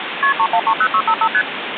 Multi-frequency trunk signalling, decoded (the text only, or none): KP 3130655 ST